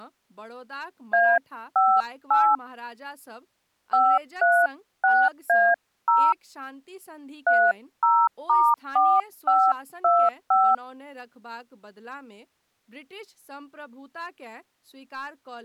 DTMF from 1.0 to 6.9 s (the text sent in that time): A58 536A0